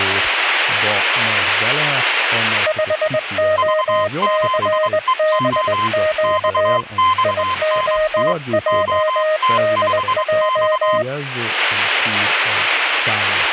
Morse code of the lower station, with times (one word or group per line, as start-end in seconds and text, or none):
2.7-6.8 5OCBQ
7.2-11.0 IOJDJ